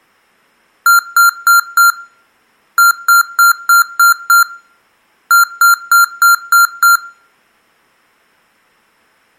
Beep code, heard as beeps from a small speaker, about 1390 Hz, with room echo. 4-6-6.